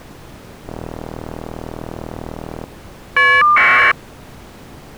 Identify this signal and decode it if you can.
Caller ID data burst, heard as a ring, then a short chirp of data, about 1200 baud.